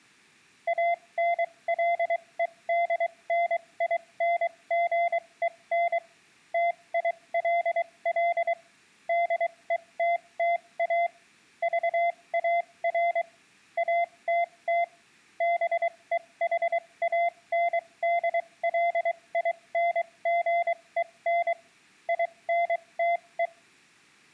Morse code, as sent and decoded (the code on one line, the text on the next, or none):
.- -. .-.. . -.. -. .. -. --. . -. / - .. .-.. .-.. / -.. . - - .- / ...- .- .-. / .- - - / -... . .... .- -. -.. .-.. .. -. --. . -. / .. -. - .
ANLEDNINGEN TILL DETTA VAR ATT BEHANDLINGEN INTE